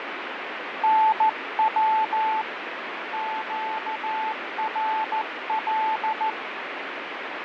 Morse code, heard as a keyed tone, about 14 wpm, 880 Hz, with radio static and fading. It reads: NW QRL